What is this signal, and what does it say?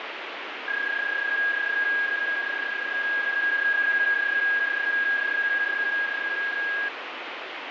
PSK31 (31.25 baud), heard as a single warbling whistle, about 1650 Hz, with radio static.